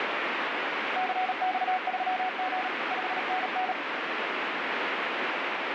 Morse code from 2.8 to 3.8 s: 5NN

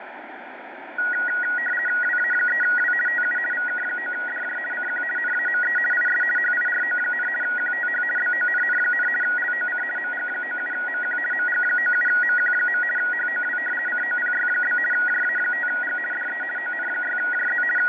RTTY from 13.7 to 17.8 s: COPY? JA5G DE ON6JZ …

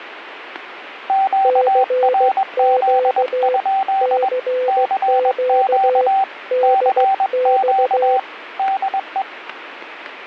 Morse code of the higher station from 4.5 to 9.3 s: CQ CQ DE

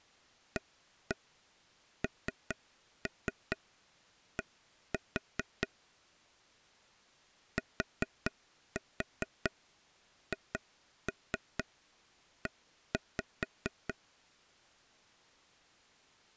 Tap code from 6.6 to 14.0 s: THE

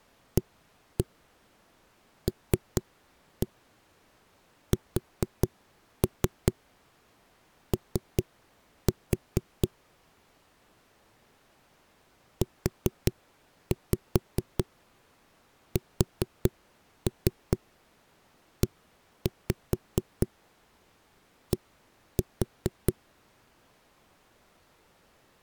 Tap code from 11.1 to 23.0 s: USED

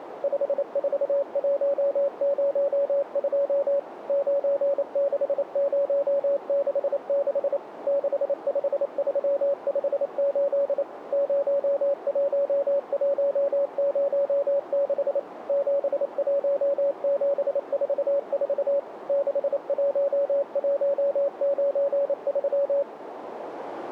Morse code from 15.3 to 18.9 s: 71744

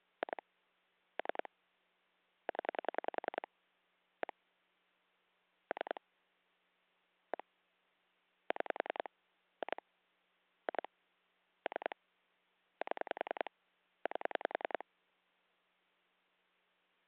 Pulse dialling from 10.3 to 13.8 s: 2 3 7

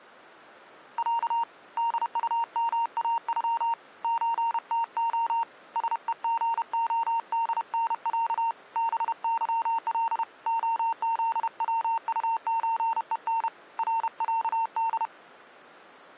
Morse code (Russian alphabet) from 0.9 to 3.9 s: Я ДУМАЮ

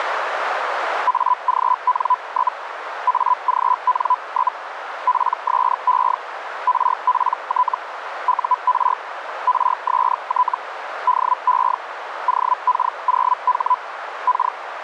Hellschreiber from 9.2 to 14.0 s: RST DE OK0H

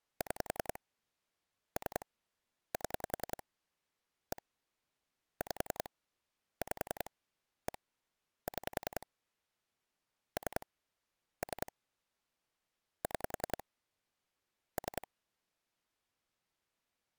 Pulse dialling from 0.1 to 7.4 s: 6 3 7 1 5 5

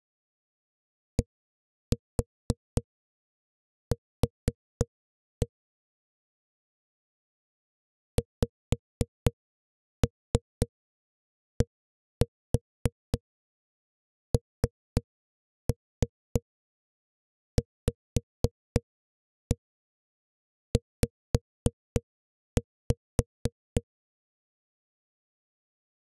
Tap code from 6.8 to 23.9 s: XDNVZ

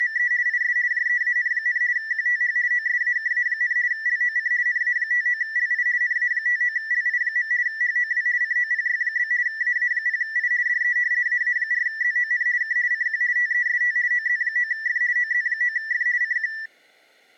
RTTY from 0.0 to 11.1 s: … IS JEAN, QTH OSAKA, LOC NA59LI NA59LI. HOW COPY? AA0I DE

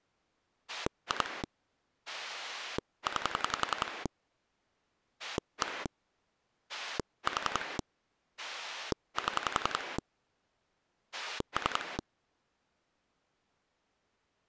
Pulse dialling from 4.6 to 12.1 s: 1 4 7 3

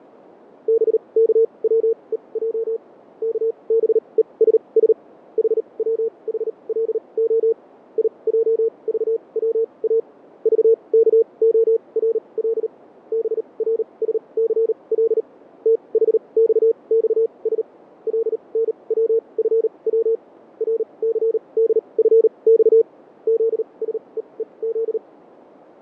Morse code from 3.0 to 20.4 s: KBESS HWHLO IJVWA VKORL BRSCL THXXS LNWFW

